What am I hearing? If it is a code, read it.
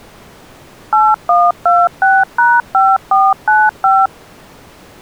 DTMF, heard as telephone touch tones, dialled by machine, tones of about 220 ms. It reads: 8126#5495